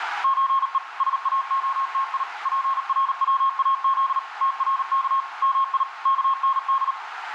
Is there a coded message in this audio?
Yes: Morse code (Persian alphabet) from 0.2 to 7.0 s, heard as a keyed tone, machine-sent, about 38 wpm, 1080 Hz, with radio static and room echo. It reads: چه ساعتی پرواز ترک می کند